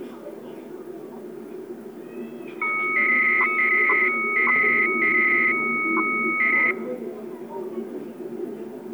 300-baud modem data (Bell 103 tones), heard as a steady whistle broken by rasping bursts, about 300 baud, 200 Hz shift, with the noise of a park.